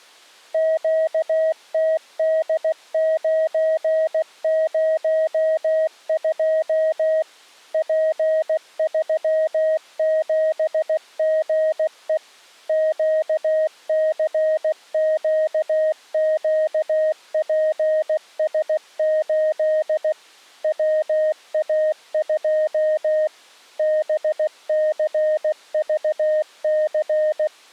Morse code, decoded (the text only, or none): QTD902 P37GE QCQQPS8 WA2 BCVC